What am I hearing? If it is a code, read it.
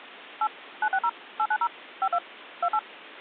DTMF, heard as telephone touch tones, dialled by machine, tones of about 60 ms. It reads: 8 960 890 52 28